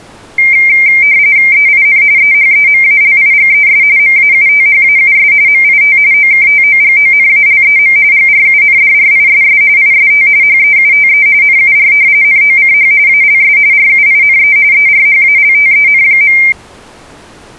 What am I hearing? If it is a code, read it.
RTTY (45.45 baud, 170 Hz shift), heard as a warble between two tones, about 2200 Hz centre. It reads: EIN EHEMALIGES MAUTHAUS MIT OKTOGONALEM GRUNDRISS IST HEUTE NUR NOCH ALS RUINE ERHALTEN.